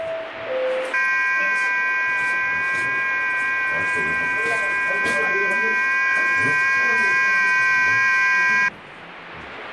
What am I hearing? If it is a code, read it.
FT8 (several signals at once), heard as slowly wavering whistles, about 6.25 baud, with radio static and the noise inside a lift.